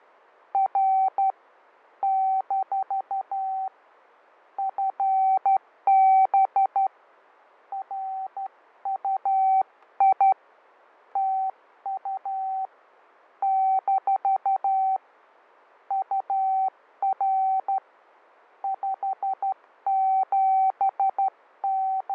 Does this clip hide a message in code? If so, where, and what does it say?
Yes: Morse code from 0.5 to 22.1 s, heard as a keyed tone, hand-sent with a straight key, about 12 wpm, 770 Hz, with fading. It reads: R - FB RUI TU - UR …